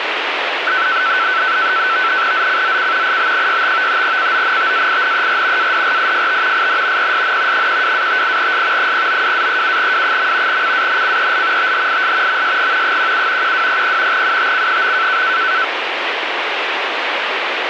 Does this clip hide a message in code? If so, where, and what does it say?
Yes: NAVTEX (SITOR-B), 100 baud, 170 Hz shift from 0.7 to 15.6 s, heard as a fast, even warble, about 1420 Hz centre, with radio static. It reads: ZCZC IB65 CONTAINER ADRIFT IN PSN 12-58S 092-37W. CANCEL THIS MSG 17 1200 UTC.